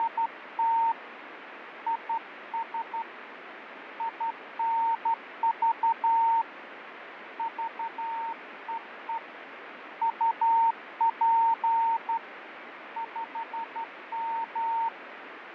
Morse code, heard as a keyed tone, hand-sent with a straight key, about 12 wpm, 910 Hz, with radio static and fading. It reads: … IS INV VEE UP 5M